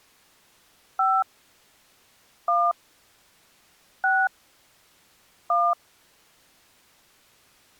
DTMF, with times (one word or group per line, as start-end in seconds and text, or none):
1.0-1.2 5
2.5-2.7 1
4.0-4.3 6
5.5-5.7 1